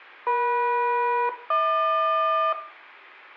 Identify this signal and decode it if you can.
Aircraft SELCAL, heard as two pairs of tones, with room echo. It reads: EM-HQ